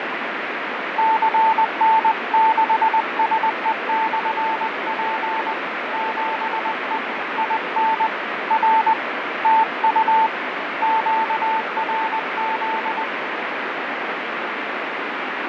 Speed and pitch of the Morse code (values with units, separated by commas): 20 wpm, 890 Hz